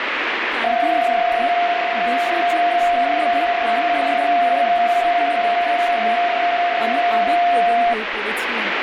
PSK31 (31.25 baud), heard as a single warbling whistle, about 700 Hz, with radio static and speech in Bangla.